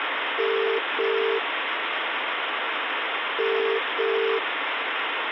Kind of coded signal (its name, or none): telephone call progress tone